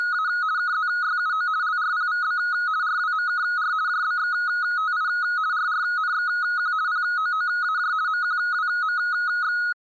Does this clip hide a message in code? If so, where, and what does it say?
Yes: RTTY (50 baud, 170 Hz shift) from 0.0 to 9.7 s, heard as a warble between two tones, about 1360 Hz centre. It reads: … KZYUO LRPVB RWMKR JBXTI RRNXQ POOAJ MQWMX